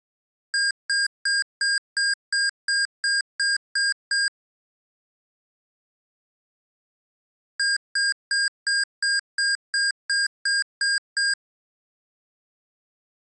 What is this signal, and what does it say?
Beep code, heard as beeps from a small speaker, played twice, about 1600 Hz. 11 short. In AMI BIOS tables: cache memory error.